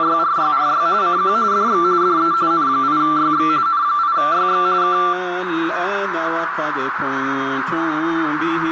RTTY (45.45 baud, 170 Hz shift), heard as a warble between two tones, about 1260 Hz centre, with radio static and a narrow filter. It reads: … CQ DX DE N8YX N8YX K